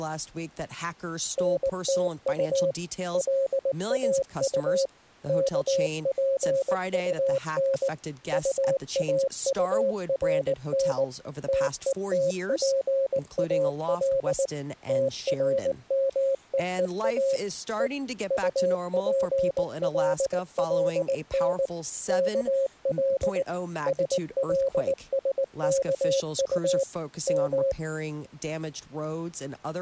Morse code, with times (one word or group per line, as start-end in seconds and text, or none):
1.4-2.7 NTU
3.1-4.9 LAU
5.3-7.9 KPUN
8.3-11.0 UAURN
11.5-14.5 TETPAL
14.9-17.4 TRMEEA
17.8-17.9 E
18.3-21.7 UPLLN
22.1-23.4 KL
23.9-26.8 SLSKU
27.3-27.7 M